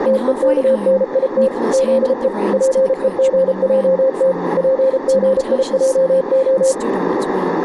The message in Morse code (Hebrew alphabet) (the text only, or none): תוכנית זו פוגעת פגיעה